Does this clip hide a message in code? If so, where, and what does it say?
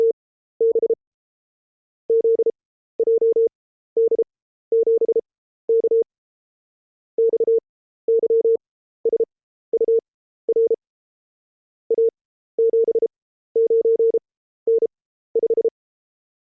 Yes: Morse code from 0.0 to 15.7 s, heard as a keyed tone, machine-sent, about 33 wpm, spaced as for 14 wpm, 460 Hz. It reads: … ZJD7K XYSUR A79N5